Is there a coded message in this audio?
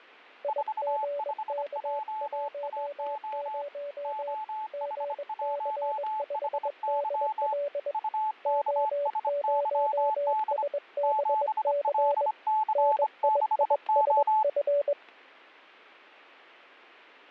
Yes: Morse code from 0.4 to 15.0 s, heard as two keyed tones, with fading and static crashes. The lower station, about 21 wpm, 570 Hz: IGK10 GC5DL O0SBC NIISF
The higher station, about 25 wpm, 870 Hz: 45JAO OH1HY UKSYD 7LC6O